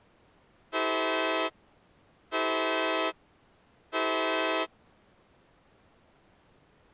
Train horn signal, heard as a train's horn. 3 short. On North American railways: when stopped, the train will back up.